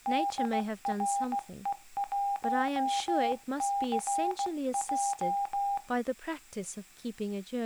Morse code, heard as a keyed tone, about 16 wpm, 800 Hz, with speech in English. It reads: DRE1CJ